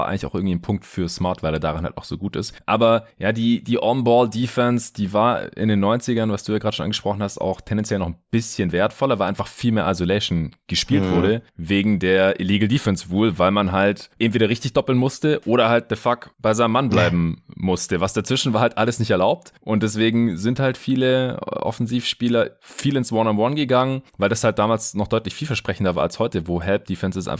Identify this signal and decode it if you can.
Speech in German. There is no code.